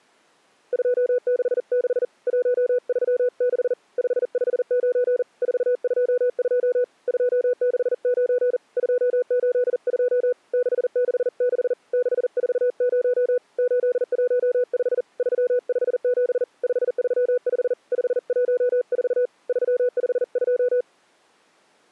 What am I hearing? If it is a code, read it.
Morse code, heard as a keyed tone, hand-sent with a paddle, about 40 wpm, 490 Hz. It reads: 266 136 559 422 269 282 666 640 815 357 535 514 352